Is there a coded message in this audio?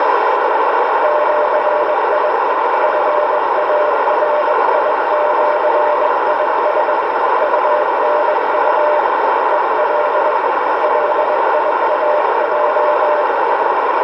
Yes: Morse code (with Esperanto letters) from 1.0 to 13.3 s, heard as a keyed tone, hand-sent with a bug key, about 21 wpm, 600 Hz, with heavy radio static and a narrow filter. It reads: ĜI FARIĜIS UNU EL LIAJ